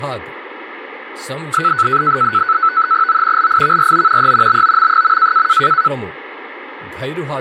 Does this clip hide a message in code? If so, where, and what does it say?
Yes: NAVTEX (SITOR-B), 100 baud, 170 Hz shift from 1.5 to 5.9 s, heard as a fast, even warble, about 1400 Hz centre, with radio static and speech in Telugu. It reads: O LIVRO E BOM.